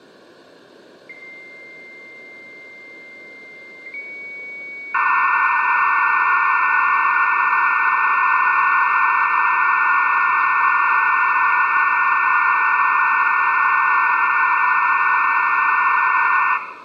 Dial-up modem handshake (low-speed, two carriers), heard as two whistles, then hiss, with room echo.